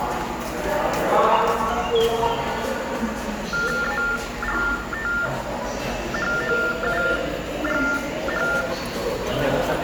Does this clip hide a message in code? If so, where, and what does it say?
Yes: TTY/TDD text telephone tones (45.45 baud Baudot) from 3.5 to 8.6 s, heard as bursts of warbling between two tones, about 400 Hz shift, 1600 Hz centre, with the noise of a subway station. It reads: ALTHOUGH